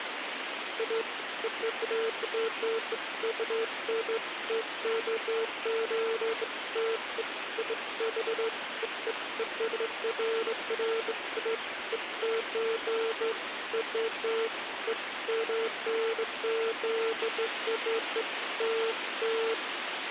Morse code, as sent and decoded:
none

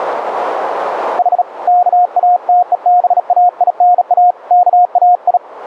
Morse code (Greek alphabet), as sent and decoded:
.... / -.- .- - . -... .- .. -. .- / -.- .- ..
Η ΚΑΤΕΒΑΙΝΑ ΚΑΙ

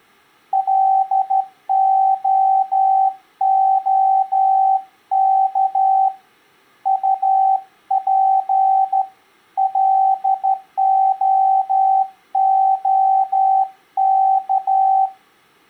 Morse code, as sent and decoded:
.-.. --- --- -.- / ..- .--. / .-.. --- --- -.-
LOOK UP LOOK

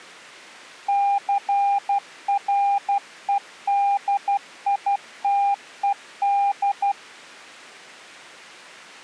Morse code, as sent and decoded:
-.-. .-. . -.. .. - . -..
CREDITED

